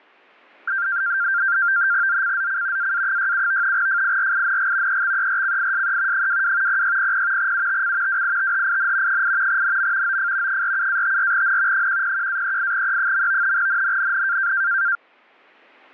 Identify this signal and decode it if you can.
NAVTEX (SITOR-B), 100 baud, 170 Hz shift, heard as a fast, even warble, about 1480 Hz centre. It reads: ZCZC AA67 FIRING EXERCISE 22 0600 UTC WITHIN 8 NM OF 47-54N 101-38E. NNNN